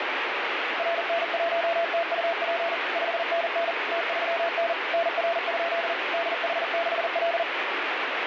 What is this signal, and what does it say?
Morse code, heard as a keyed tone, machine-sent, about 40 wpm, 680 Hz, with heavy radio static. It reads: RN1TUP 5NN T3N NR? DH6L